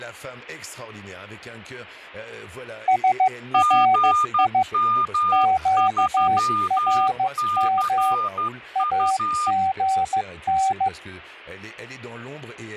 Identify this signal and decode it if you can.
Morse code, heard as two keyed tones. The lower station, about 15 wpm, 760 Hz: SRI QRM AGN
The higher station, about 12 wpm, 1210 Hz: GM3CU